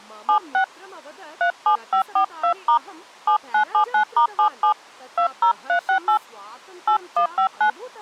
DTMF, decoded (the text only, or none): 76 37542* 7979*77 20368 8159